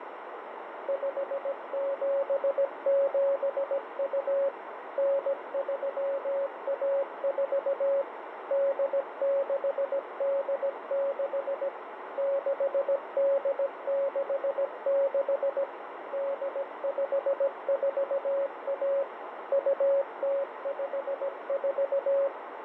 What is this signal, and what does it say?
Morse code (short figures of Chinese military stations), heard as a keyed tone, machine-sent, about 17 wpm, 550 Hz, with radio static and a narrow filter. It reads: 5772 9314 8686 6866 8541 2054